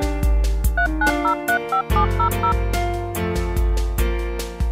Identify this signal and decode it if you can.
DTMF, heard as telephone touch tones, dialled by machine, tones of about 90 ms. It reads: 39035700